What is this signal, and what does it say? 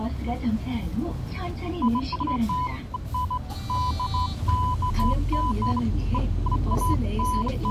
Beeps of irregular length, with the noise inside a bus. There is no code.